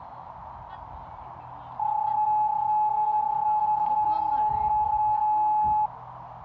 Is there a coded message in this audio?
Yes: PSK31 (31.25 baud) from 1.8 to 5.9 s, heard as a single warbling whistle, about 850 Hz, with radio static, a narrow filter and the noise of a residential street.